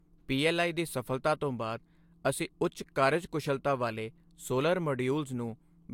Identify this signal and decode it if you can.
Speech in Punjabi. There is no code.